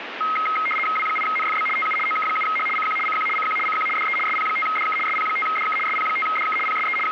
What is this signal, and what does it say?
RTTY (75 baud, 850 Hz shift), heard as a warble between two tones, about 1700 Hz centre, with radio static. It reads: W8NFB TU OK7H CQ CQ CQ CQ DE SP5DK SP5DK SP5DK PSE …